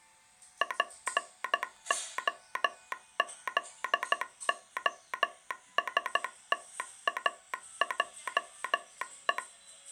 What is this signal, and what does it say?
Morse code, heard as a telegraph sounder, machine-sent, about 13 wpm, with the noise of a cafe. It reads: POZOSTAJE